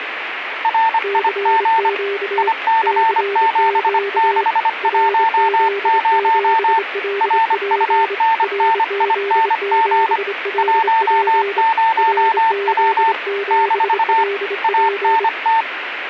Morse code, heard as two keyed tones, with radio static. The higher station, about 25 wpm, 900 Hz: RIG IC7610 RUNNING 10W - ANT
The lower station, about 26 wpm, 400 Hz: CQ CQ RZ7LP RZ7LP RZ7LP